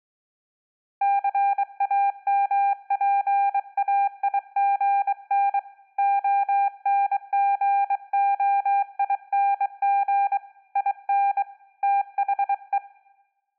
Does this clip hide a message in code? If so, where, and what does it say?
Yes: Morse code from 1.0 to 12.8 s, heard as a keyed tone, hand-sent with a bug key, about 23 wpm, 800 Hz. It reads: CAMPAIGN ONGOING IN THE